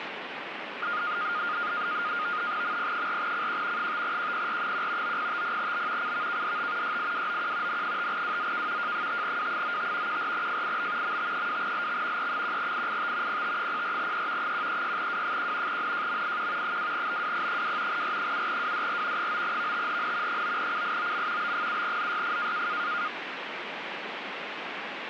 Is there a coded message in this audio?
Yes: NAVTEX (SITOR-B), 100 baud, 170 Hz shift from 0.8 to 23.1 s, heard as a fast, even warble, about 1320 Hz centre, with radio static. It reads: MP4CQ 5QPR1 9050B CVKDT YIWOQ N5WZK J5W95 14FIB MT2LX E1IIT PT04E 136W1 NJMIQ 2BWP2 R7WDR 9VTHN 9CIOM B7ZYF